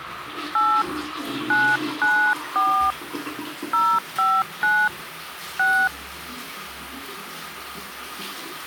DTMF, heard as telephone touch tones, dialled by hand, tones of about 280 ms, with the noise of a restroom. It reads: 8 994 059 6